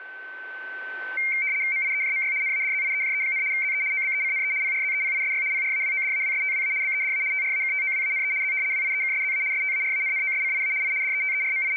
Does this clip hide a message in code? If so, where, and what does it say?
Yes: RTTY (75 baud, 170 Hz shift) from 1.2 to 11.8 s, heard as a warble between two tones, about 2200 Hz centre, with a steady whistle near 1530 Hz. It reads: MIEJMY NADZIEJE, ZE OBECNE PRZEPISY PRAWODAWSTWA BEDA TRAKTOWANE Z WIEKSZA STARANNOSCIA I …